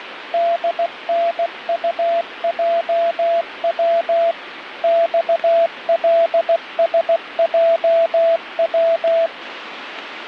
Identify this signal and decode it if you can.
Morse code, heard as a keyed tone, machine-sent, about 16 wpm, 670 Hz, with radio static. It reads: DNUJW XLSJW